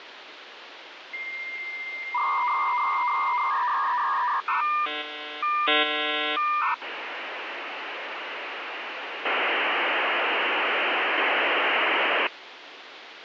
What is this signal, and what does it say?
Dial-up modem handshake (V.34 or later), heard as a whistle, warbles, then hiss, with phone line noise.